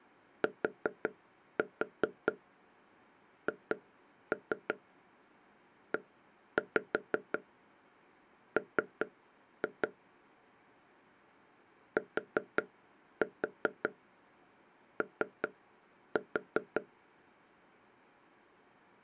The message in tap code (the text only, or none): THEM TO